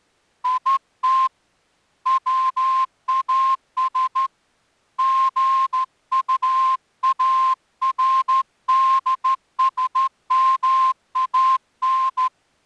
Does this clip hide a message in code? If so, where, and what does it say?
Yes: Morse code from 0.4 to 12.3 s, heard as a whistle, hand-sent with a straight key, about 13 wpm. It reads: IT WAS GUARDSMAN